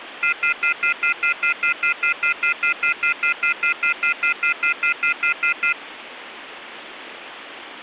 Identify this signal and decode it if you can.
Telephone call progress tone (North American plan), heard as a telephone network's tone, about 1400, 2050, 2450, 2600 Hz, 0.1 s on and 0.1 s off, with phone line noise. Off-hook warning tone.